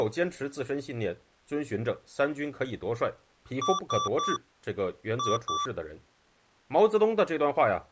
Beep code, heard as beeps from a small speaker, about 1160 Hz, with speech in Chinese. 3-2.